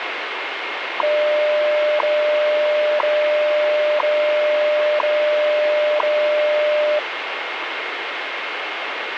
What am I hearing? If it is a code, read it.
Radio time signal (WWV, Colorado), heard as ticks, one a second, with radio static.